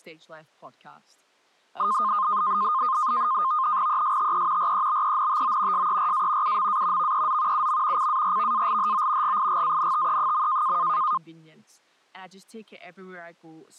NAVTEX (SITOR-B), 100 baud, 170 Hz shift, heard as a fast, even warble, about 1140 Hz centre. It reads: ESTE REBENTO SERA UMA VEZ UM CARVALHO GIGANTE.